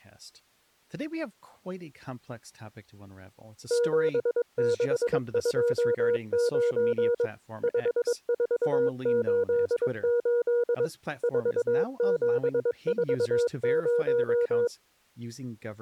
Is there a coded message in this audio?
Yes: Morse code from 3.6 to 14.7 s, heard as a keyed tone, machine-sent, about 22 wpm, 480 Hz, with speech in English. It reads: 7629 5488 4740